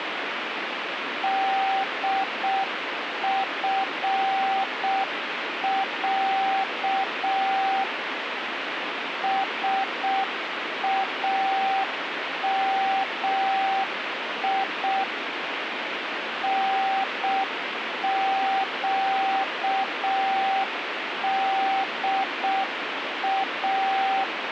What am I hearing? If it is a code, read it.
Morse code (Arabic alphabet), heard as a keyed tone, machine-sent, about 6 wpm, 780 Hz, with radio static. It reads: دفع سامي نقدا